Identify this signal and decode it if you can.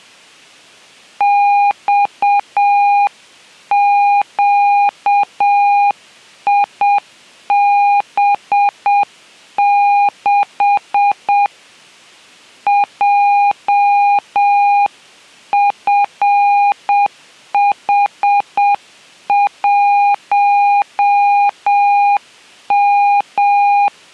Morse code, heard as a keyed tone, hand-sent with a paddle, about 7 wpm, 810 Hz. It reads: XQIB6 JFH1M